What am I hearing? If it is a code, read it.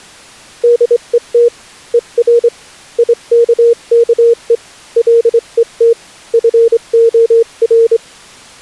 Morse code, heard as a keyed tone, hand-sent with a straight key, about 24 wpm, 470 Hz. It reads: DET ER IKKE LET FOR